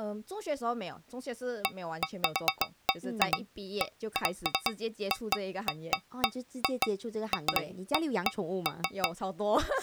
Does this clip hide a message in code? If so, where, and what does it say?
No, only irregular taps on a metal pipe.